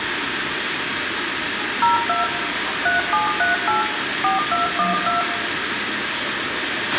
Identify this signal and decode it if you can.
DTMF, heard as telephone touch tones, dialled by machine, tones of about 150 ms, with radio hiss, a squelch burst at the end, room echo and the noise of a crowd indoors. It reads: 02 3738 4212